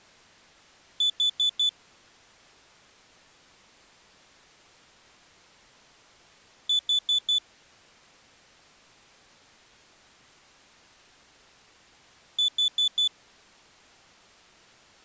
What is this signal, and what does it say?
Alarm pattern, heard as an alarm's beeps, played three times, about 3500 Hz. Temporal four. Carbon monoxide.